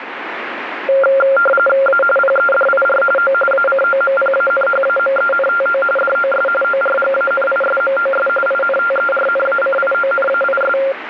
RTTY (45.45 baud, 850 Hz shift), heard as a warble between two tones, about 970 Hz centre, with radio static. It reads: A PEDIR O ACOMPANHAMENTO DOS ORGANISMOS INTERNACIONAIS